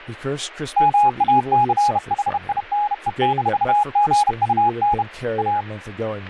Morse code, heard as a keyed tone, hand-sent with a bug key, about 31 wpm, 830 Hz, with speech in English. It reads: MACHINE-GUN A